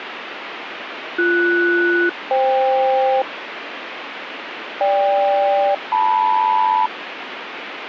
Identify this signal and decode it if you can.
Aircraft SELCAL, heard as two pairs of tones, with radio static. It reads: BS-FK GK-LM